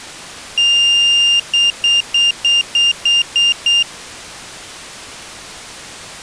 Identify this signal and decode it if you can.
Beep code, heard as a piezo beeper, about 2800 Hz. 1 long, 8 short. In AMI BIOS tables: display or retrace test failure.